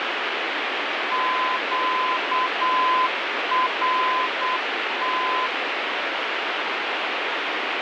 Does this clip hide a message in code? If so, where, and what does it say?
Yes: Morse code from 1.1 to 5.5 s, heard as a keyed tone, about 8 wpm, 1020 Hz, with heavy radio static. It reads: QRT